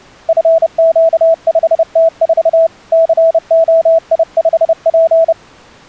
Morse code, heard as a keyed tone, hand-sent with a paddle, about 30 wpm, 660 Hz. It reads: FQ5T4 COI5P